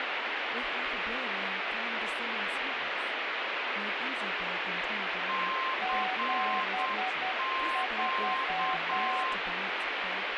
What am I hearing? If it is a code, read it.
Morse code, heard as two keyed tones, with heavy radio static and speech in English. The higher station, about 8 wpm, 1050 Hz: CQ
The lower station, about 10 wpm, 750 Hz: 73